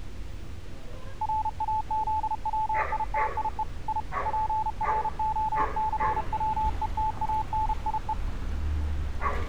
Morse code (Russian alphabet), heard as a keyed tone, hand-sent with a paddle, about 32 wpm, 870 Hz, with street noise. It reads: РАЗВИТИЕ И ПРОЦВЕТАНИЕ